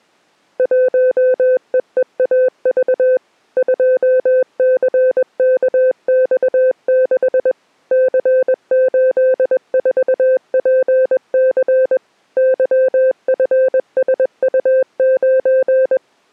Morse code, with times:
0.6-3.2 1EEAV
3.6-7.5 2CKX6
7.9-12.0 C84PC
12.4-16.0 YFSU9

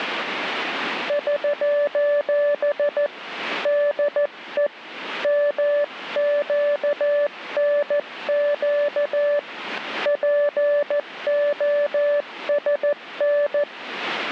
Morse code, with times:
1.1-3.1 <SOS>
3.7-4.7 DE
5.2-9.4 MQNQ
10.1-13.6 POSN

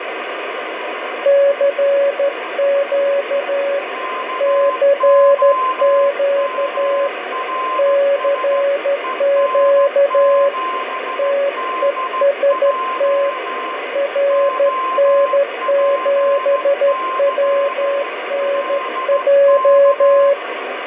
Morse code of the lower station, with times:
1.3-3.8 CQ
4.4-7.1 CQ
7.8-10.5 CQ
11.2-13.3 TEST
14.0-20.3 RN7WNJ

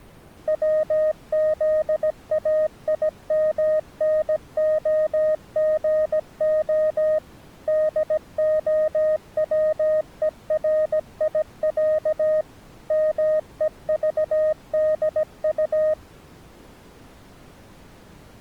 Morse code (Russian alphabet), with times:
0.5-7.2 ВЗАИМНОГО
7.7-12.4 ДОВЕРИЯ
12.9-15.9 МЕЖДУ

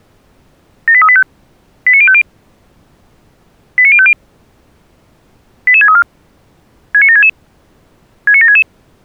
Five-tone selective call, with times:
0.9-1.2 78385
1.9-2.2 89050
3.8-4.1 89050
5.7-6.0 88634
6.9-7.3 69766
8.3-8.6 69766

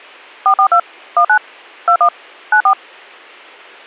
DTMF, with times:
0.5-0.8 442
1.2-1.4 19
1.9-2.1 21
2.5-2.7 94

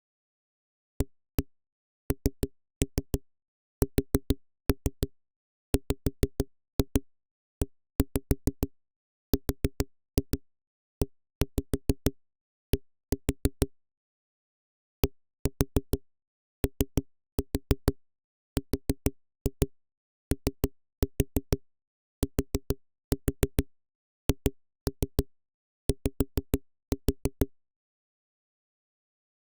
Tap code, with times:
1.0-13.7 ANSWERED
15.0-27.5 DOROTHY

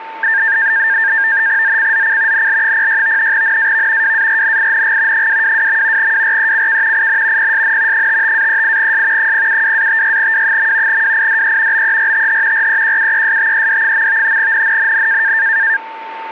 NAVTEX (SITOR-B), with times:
1.6-2.5 ZCZC
2.3-3.3 NL06
3.3-4.1 NAV
4.0-5.3 WARNING
5.1-6.1 222.
6.0-7.1 WRECK
6.9-7.5 IN
7.4-8.1 PSN
7.9-9.3 55-38S
9.2-11.0 072-56W.
10.9-11.8 WIDE
11.7-12.7 BERTH
12.5-14.4 REQUESTED.
14.4-15.3 NNNN

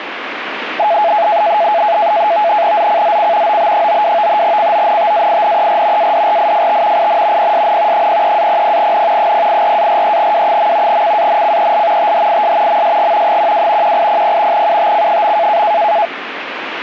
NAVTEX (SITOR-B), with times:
2.8-3.6 ZCZC
3.5-4.4 OB92
4.4-6.1 CONTAINER
6.0-7.1 ADRIFT
7.0-7.5 IN
7.4-8.1 PSN
7.9-9.3 03-00N
9.2-11.0 084-43W.
10.9-12.1 CANCEL
12.0-12.8 THIS
12.7-13.4 MSG
13.3-14.0 12
13.8-14.7 1800
14.5-15.6 UTC.

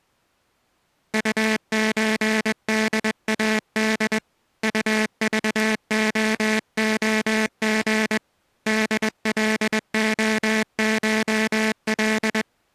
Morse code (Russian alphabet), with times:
1.1-4.2 УЧДАД
4.6-8.2 УЖООГ
8.7-12.4 ДЛОШЛ

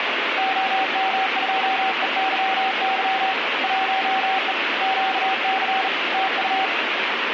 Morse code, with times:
0.4-3.3 OM2EYY
3.6-4.5 1E
4.8-5.9 QC
6.1-6.7 TU

